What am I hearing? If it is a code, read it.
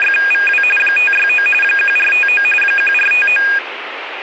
RTTY (45.45 baud, 850 Hz shift), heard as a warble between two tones, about 2050 Hz centre, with radio static. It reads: … 569 1459 1459